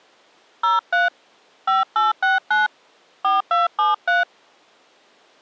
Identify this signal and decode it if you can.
DTMF, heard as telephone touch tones, dialled by hand, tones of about 160 ms. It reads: 03 5869 4273